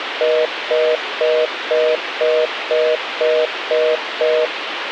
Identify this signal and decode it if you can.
Telephone call progress tone (North American plan), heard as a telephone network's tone, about 480, 620 Hz, 0.25 s on and 0.25 s off, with phone line noise. Congestion tone.